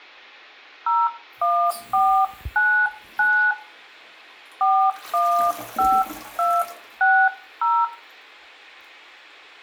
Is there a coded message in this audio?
Yes: DTMF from 0.9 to 7.8 s, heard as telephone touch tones, dialled by hand, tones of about 290 ms, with room echo and the noise of a restroom. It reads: 01499 415260